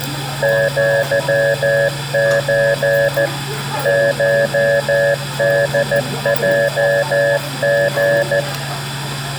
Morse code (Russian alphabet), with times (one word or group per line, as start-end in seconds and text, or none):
0.4-3.3 ЪЧ
3.9-8.4 ШДЙГ